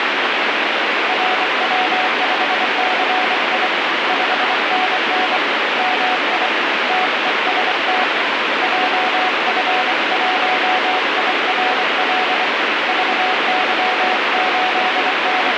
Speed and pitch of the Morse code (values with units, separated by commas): 24 wpm, 740 Hz